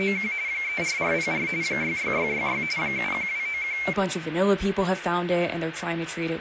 RTTY (45.45 baud, 170 Hz shift), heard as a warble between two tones, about 2250 Hz centre, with radio static and speech in English. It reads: … 34404 66666 71291